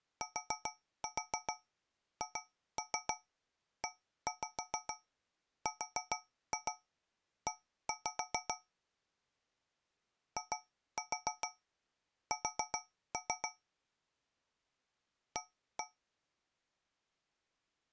Tap code, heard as taps on a metal pipe, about 7 knocks a second. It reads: THERE IS A